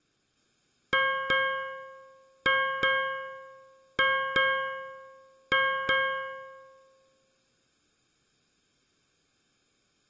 Ship's bell, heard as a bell, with room echo. 8. Eight half-hours of the watch have passed.